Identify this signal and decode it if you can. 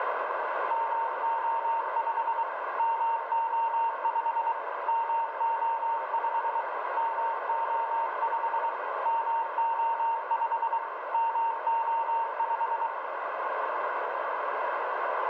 Morse code, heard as a keyed tone, machine-sent, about 23 wpm, 920 Hz, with heavy radio static and a narrow filter. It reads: MO5 MO5 MO5 MO5 MO5 MO5